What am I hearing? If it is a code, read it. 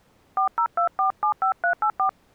DTMF, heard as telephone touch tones, dialled by hand, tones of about 100 ms. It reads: 402475384